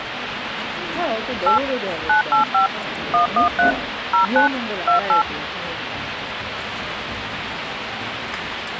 DTMF, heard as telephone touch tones, dialled by machine, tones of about 120 ms, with phone line noise and the noise of a restaurant. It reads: 8 985 113 09 28